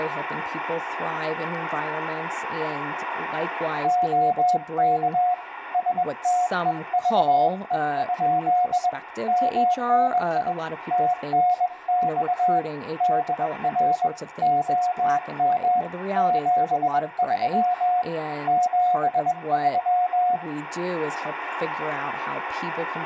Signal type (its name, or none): Morse code